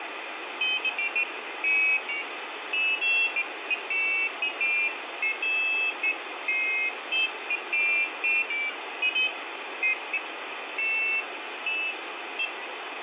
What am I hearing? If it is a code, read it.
Pairs of high tones at irregular times, with phone line noise and room echo. There is no code.